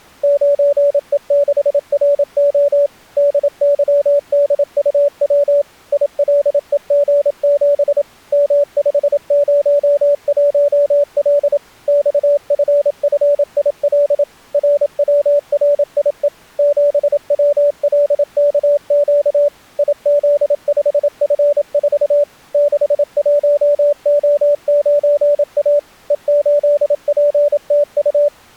Morse code, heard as a keyed tone, machine-sent, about 27 wpm, 580 Hz. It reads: 9E6RO DYDUW ILEG7 M501L XFFIL RWRIE 7WLKQ IZ5F4 61O9A E8PTU